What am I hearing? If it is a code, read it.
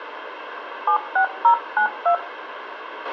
DTMF, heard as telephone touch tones, dialled by hand, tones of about 90 ms, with radio hiss and a squelch burst at the end. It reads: 76092